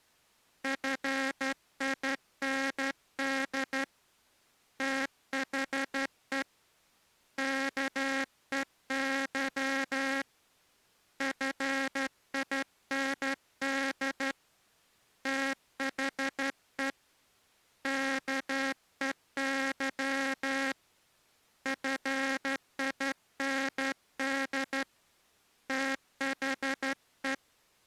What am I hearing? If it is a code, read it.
Morse code, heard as a buzzer, hand-sent with a straight key, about 12 wpm. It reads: FIND THE KEY FIND THE KEY FIND THE